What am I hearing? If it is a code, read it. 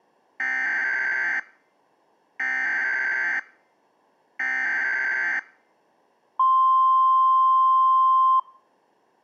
Emergency Alert System (SAME) tones (header bursts, then the 1050 Hz attention tone), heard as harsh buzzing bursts, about 520.83 baud.